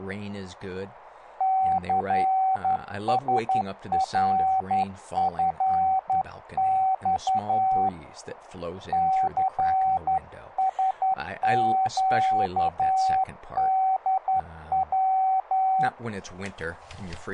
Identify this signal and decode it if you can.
Morse code, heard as a keyed tone, hand-sent with a straight key, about 11 wpm, 760 Hz, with speech in English. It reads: CSRFX CSQDW